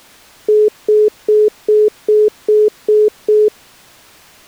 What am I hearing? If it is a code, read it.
Telephone call progress tone (single-tone plan, as in most of Europe), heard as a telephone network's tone, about 420 Hz, 0.2 s on and 0.2 s off. Congestion tone.